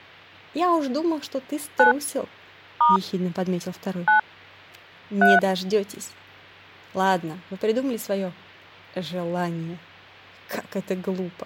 DTMF, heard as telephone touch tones, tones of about 150 ms. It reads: 9 * 9 3